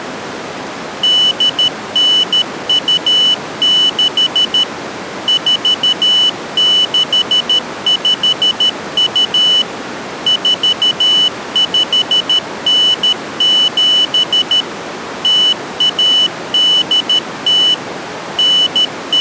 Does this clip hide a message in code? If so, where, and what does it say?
Yes: Morse code (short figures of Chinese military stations) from 1.0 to 19.2 s, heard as a high beeper, machine-sent, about 13 wpm, 3000 Hz. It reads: 8926 4652 4597 0180 …